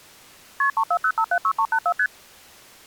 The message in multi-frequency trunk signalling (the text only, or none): KP 340576384 ST